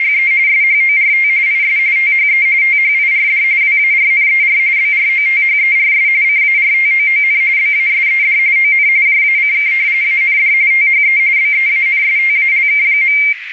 RTTY (45.45 baud, 170 Hz shift), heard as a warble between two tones, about 2200 Hz centre, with radio static and a narrow filter. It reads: … SHORT IS THE THIRD WARNER BROTHERS CARTOON BASED ON JACK AND THE BEANSTALK.